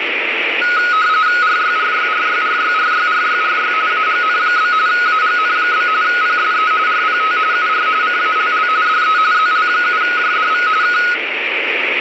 RTTY (45.45 baud, 170 Hz shift), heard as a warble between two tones, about 1360 Hz centre, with radio static and room echo. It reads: RYRYRYRYRYRYRY AGN? AGN? PSE RPT UR CALL DE ZL7JDV K